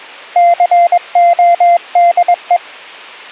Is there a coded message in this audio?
Yes: Morse code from 0.3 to 2.6 s, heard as a keyed tone, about 21 wpm, 690 Hz. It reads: CODE